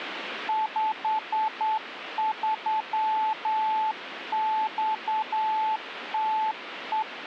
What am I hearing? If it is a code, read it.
Morse code, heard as a keyed tone, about 9 wpm, 870 Hz, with radio static. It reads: 53XTE